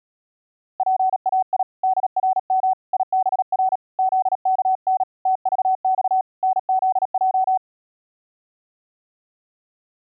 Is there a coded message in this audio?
Yes: Morse code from 0.7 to 7.6 s, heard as a keyed tone, hand-sent with a paddle, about 37 wpm, 750 Hz. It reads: PAI DRM IBR ZKN TVX NZJ